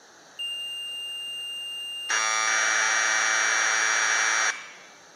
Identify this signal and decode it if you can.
Commodore tape loading (standard loader), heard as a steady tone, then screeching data, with room echo.